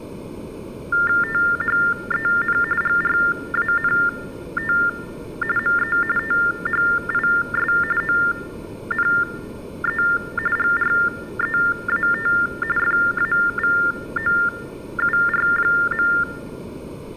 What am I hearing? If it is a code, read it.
TTY/TDD text telephone tones (45.45 baud Baudot), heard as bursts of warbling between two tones, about 400 Hz shift, 1600 Hz centre. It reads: THEN GRANT ME THIS ONE GREAT FAVOUR.